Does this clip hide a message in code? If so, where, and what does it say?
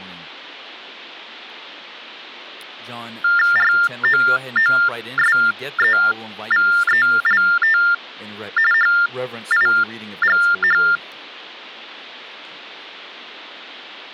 Yes: TTY/TDD text telephone tones (45.45 baud Baudot) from 3.2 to 11.0 s, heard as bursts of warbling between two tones, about 400 Hz shift, 1600 Hz centre, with speech in English. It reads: ROOSEVELT HIGH